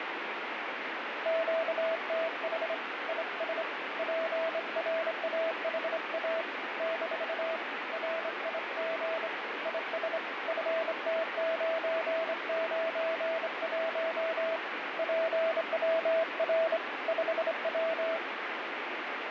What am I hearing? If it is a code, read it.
Morse code, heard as a keyed tone, hand-sent with a straight key, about 26 wpm, 650 Hz, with heavy radio static. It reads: QTH IS PRAHA - RIG IS FT991 PWR 5W